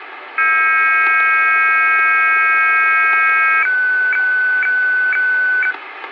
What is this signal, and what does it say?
Weather fax (radiofax), 120 lines a minute, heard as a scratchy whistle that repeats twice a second, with radio static.